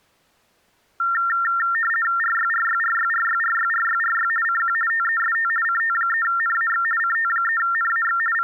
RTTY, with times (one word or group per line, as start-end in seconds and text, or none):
2.2-4.3 RYRYRYRYRYRYRY
4.4-4.7 CQ
4.9-5.5 TEST
5.6-6.8 CT3NAX
7.0-8.2 CT3NAX
8.3-8.4 …